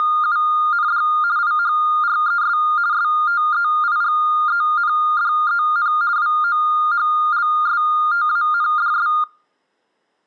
RTTY (50 baud, 170 Hz shift), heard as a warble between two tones, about 1310 Hz centre. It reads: … IHRES STEIGENDEN WOHLSTANDS